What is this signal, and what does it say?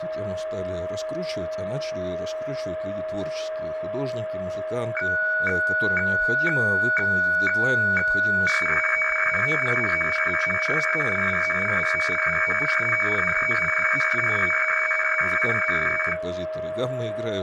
Weather fax (radiofax), 120 lines a minute, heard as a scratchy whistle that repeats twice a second, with a steady whistle near 630 Hz and speech in Russian.